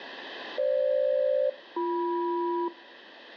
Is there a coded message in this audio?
Yes: aircraft SELCAL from 0.6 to 2.7 s, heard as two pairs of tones, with radio static. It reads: FG-BM